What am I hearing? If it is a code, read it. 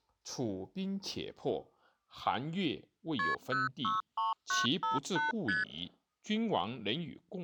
Multi-frequency trunk signalling (R1, as on North American trunks), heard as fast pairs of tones, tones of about 160 ms, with speech in Chinese. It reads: KP 063958 ST